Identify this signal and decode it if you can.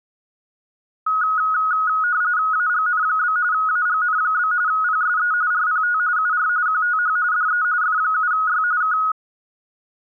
RTTY (45.45 baud, 170 Hz shift), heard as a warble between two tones, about 1360 Hz centre. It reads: AGN? AGN? PSE RPT UR QTH DE F7Y K